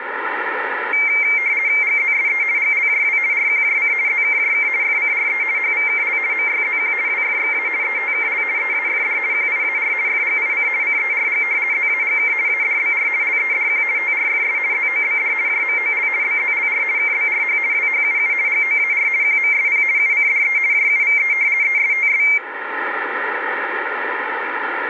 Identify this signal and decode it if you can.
RTTY (50 baud, 170 Hz shift), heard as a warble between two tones, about 2200 Hz centre, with radio static and room echo. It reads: GZSE GLJW RQJC ZKJK FCRE HVKL MYZQ WFXA ETKL EAFD QIAR FGIC CERG ZAGK ADBR LEDQ TRFS ZOBD JMOL BZLR KBRH WHUU GOAR QMSP UCDE JUVE ESTS